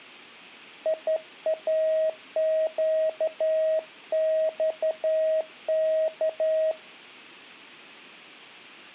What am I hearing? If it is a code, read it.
Morse code, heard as a keyed tone, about 13 wpm, 630 Hz. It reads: IAQXK